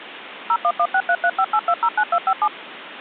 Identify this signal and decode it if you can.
DTMF, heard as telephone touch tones, dialled by machine, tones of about 60 ms, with phone line noise. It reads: 01163358209257